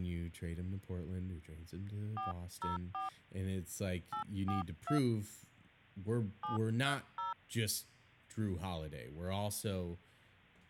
DTMF, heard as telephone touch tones, dialled by hand, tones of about 100 ms, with speech in English. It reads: 404 842 730